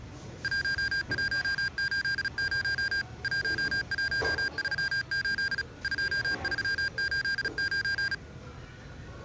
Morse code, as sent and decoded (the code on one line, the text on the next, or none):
.---- .---- ---.. ----- / .---- .---- ...-- ---.. / ..--- ...-- ---.. ----.
1180 1138 2389